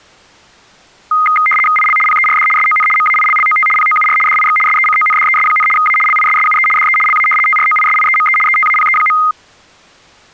RTTY (75 baud, 850 Hz shift), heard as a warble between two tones, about 1650 Hz centre. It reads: IL PERD SON MAILLOT POUR DIX SECONDES, A LISSUE DE LA TROISIEME ETAPE.